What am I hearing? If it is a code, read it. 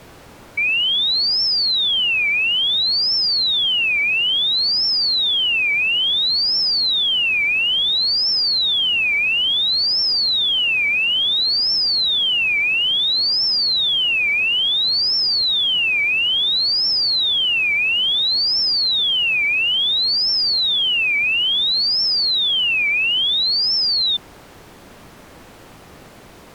A tone that sweeps in pitch again and again. There is no code.